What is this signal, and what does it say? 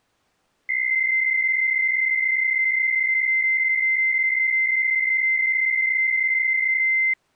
PSK63 (62.5 baud), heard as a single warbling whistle, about 2100 Hz.